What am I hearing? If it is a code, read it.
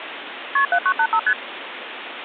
Multi-frequency trunk signalling (R1, as on North American trunks), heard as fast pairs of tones, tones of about 70 ms, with phone line noise. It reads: KP 7985 ST